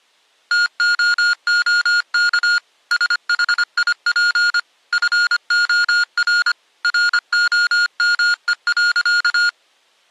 Morse code, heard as electronic beeps, machine-sent, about 25 wpm, 1430 Hz. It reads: TOOK SHIP FOR ROME.